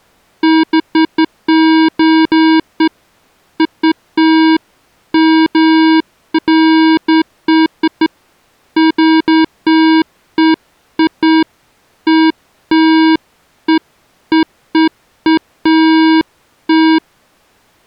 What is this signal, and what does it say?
Beeps of irregular length. There is no code.